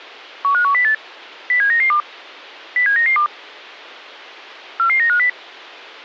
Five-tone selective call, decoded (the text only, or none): 15108 07992 07992 44950